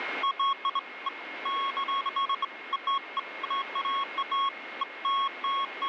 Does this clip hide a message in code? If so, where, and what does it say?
No, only beeps of irregular length, with radio static and a steady whistle near 2150 Hz.